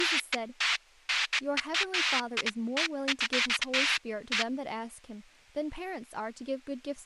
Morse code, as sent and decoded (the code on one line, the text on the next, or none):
none